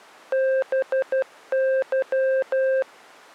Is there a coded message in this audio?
Yes: Morse code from 0.3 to 2.9 s, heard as a keyed tone, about 12 wpm, 530 Hz. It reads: BY